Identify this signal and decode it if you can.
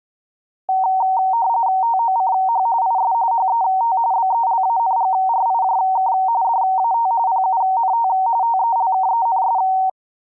RTTY (45.45 baud, 170 Hz shift), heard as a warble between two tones, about 840 Hz centre. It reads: TOCH IS HET BELANGRIJK DAT PUNT TELKENS